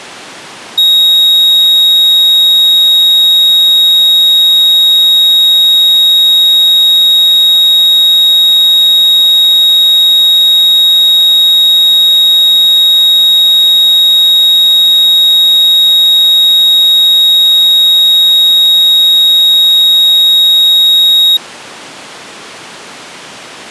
A steady tone. There is no code.